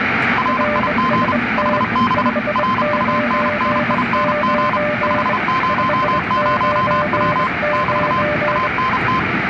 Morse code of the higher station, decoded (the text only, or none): RIG HB RUNNING 500W <BT> ANT